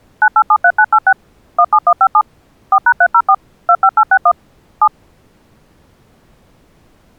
DTMF, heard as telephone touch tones, dialled by machine, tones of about 60 ms. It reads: 9873986 17157 4#304 25861 7